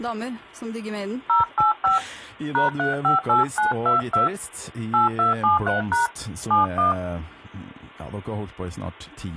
DTMF, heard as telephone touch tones, dialled by hand, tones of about 140 ms. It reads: 085 #358922 8273# 71